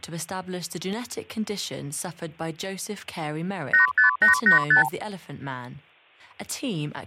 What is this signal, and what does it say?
Multi-frequency trunk signalling (R2, with the far end's replies), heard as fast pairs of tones, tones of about 120 ms, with speech in English. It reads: 85885